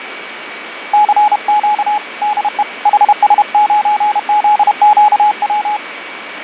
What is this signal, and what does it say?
Morse code, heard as a keyed tone, hand-sent with a paddle, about 31 wpm, 840 Hz, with radio static, fading and a steady whistle near 2270 Hz. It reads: CQ DE HS9ZQW